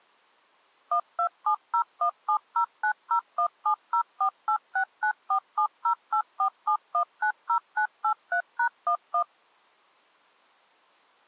DTMF, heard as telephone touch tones, dialled by machine, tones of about 90 ms. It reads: 1270170901704869470847190983#11